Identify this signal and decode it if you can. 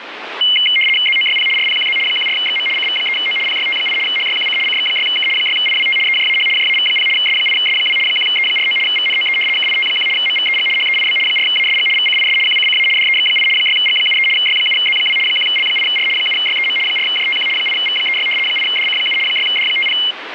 RTTY (75 baud, 850 Hz shift), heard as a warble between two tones, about 2550 Hz centre, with radio static. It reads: ZOYP RPQZ 14XM CV3O PYT8 HYQC CX6K 6IWT EJAH JAV0 S8S2 1E49 VNOE KIT1 MVEG HEIB 4ASG VCIS QCCA DEX8 6G73 Y7Z2 1L8R 7YEM 4JTQ 8V36 8DC7 6D50